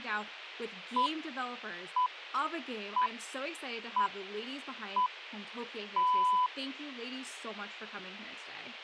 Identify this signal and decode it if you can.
Radio time signal (six pips, as the Greenwich Time Signal), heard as pips, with speech in English.